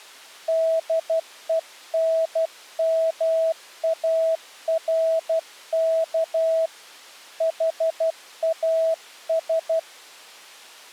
Morse code, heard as a keyed tone, hand-sent with a paddle, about 12 wpm, 650 Hz. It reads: DENMARK HAS